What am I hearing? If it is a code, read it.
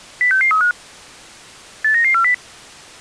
Five-tone selective call (CCIR), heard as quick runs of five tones, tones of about 100 ms. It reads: 06635 89940